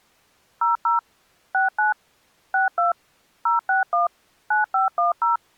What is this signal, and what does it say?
DTMF, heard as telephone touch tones, dialled by machine, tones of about 140 ms. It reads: 00 69 62 061 9510